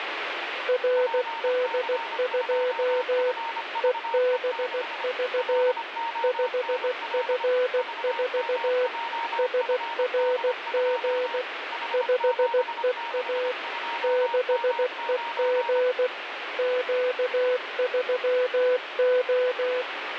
Morse code, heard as two keyed tones, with radio static. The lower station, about 16 wpm, 500 Hz: RD2 EBV 5F4 SRG 5EA 6EG Q3O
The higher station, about 25 wpm, 930 Hz: PC2FVE6 LONL VMJFD2 H762M9